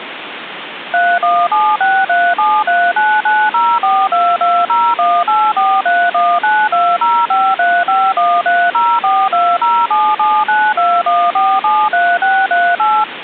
DTMF, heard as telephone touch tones, dialled by machine, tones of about 240 ms, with phone line noise. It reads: 317637399042201843192053513042077921473638